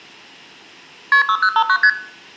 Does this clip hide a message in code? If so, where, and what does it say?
Yes: multi-frequency trunk signalling (R1, as on North American trunks) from 1.1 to 1.9 s, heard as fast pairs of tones, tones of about 70 ms, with room echo. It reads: KP 6059 ST